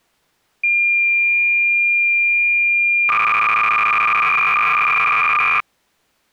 Cassette data (Kansas City type), 300 baud, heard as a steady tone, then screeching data.